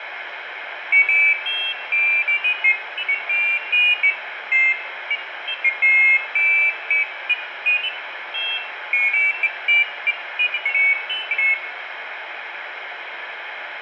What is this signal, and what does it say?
Pairs of high tones at irregular times, with radio static and room echo. There is no code.